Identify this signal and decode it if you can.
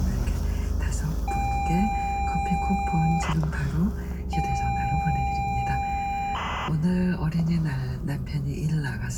ZX Spectrum tape loading, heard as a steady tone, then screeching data, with the noise inside a car.